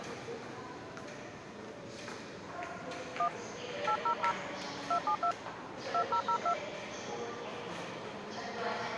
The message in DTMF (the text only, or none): 1 800 272 2002